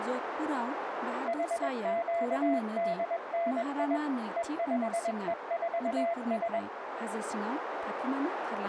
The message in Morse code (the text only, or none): HQDNI E5E4S